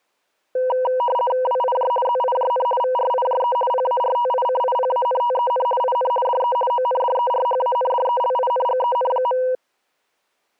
RTTY (50 baud, 450 Hz shift), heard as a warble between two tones, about 740 Hz centre. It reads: WIJ ZIJN VRIJE PARTICIPANTEN IN DE ONDERHANDELINGEN.